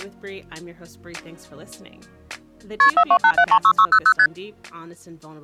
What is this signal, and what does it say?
Multi-frequency trunk signalling (R1, as on North American trunks), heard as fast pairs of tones, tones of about 70 ms. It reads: KP 428736600 ST